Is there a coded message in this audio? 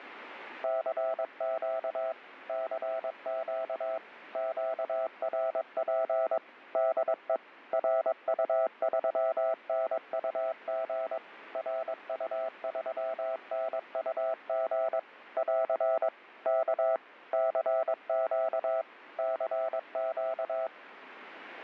Yes: Morse code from 0.6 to 20.7 s, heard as a keyed tone, machine-sent, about 22 wpm, 660 Hz, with radio static. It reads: CQ CQ QRP DE RU3NUG RU3NUG <AR> K CQ CQ